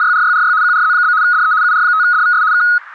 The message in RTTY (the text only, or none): … QRZ? DE UR5DVS K